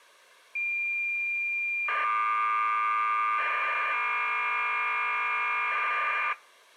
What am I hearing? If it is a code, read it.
Cassette data (Kansas City type), 1200 baud, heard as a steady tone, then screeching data.